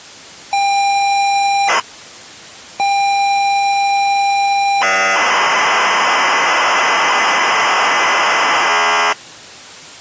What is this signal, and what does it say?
ZX Spectrum tape loading, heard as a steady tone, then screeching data.